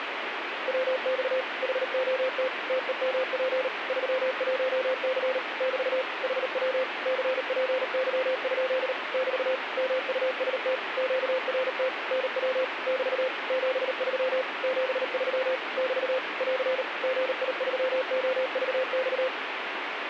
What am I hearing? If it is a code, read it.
Morse code, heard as a keyed tone, machine-sent, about 38 wpm, 520 Hz, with radio static. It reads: WX HOT TEMP 31C <BT> HW CPY? <BT> MUST QRT NW <BT> 73 73 <BT> <AR> GI3OVX